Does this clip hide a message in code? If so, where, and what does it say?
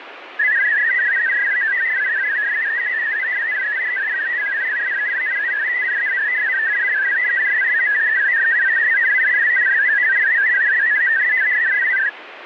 Yes: multi-tone FSK (Olivia or MFSK type), about 500 Hz wide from 0.4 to 12.1 s, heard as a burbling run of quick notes, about 62.5 baud, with radio static.